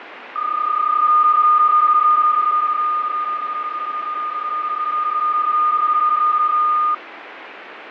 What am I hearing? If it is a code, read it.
PSK31 (31.25 baud), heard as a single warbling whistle, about 1220 Hz, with radio static and fading.